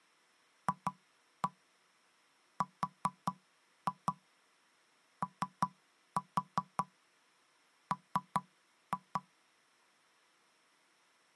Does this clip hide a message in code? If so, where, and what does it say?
Yes: tap code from 0.7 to 9.3 s, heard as knocks on wood, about 5 knocks a second. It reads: FROM